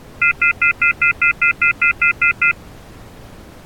Telephone call progress tone (North American plan), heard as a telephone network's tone, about 1400, 2050, 2450, 2600 Hz, 0.1 s on and 0.1 s off. Off-hook warning tone.